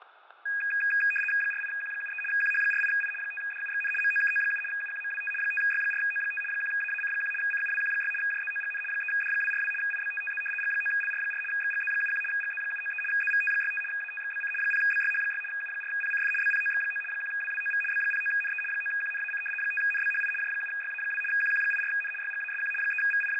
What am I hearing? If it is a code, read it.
RTTY (75 baud, 850 Hz shift), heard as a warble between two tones, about 2050 Hz centre, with fading and static crashes. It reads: 48Q73 QH48I 5DUXN MOKO7 UQMWT 5Y4O5 1AAC1 CUWQ6 JZOGN 3D242 IBTTZ G9LR4 XGZ71 GZ793 ZVT65 ATXBC 0BYH6 U4PCF BPOX9 1WWOV B09NE 9QNAC 5NBHI J7YA2 QQ84N YGASQ …